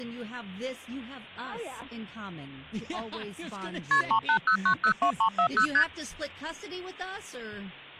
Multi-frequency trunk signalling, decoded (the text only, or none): KP 380902340 ST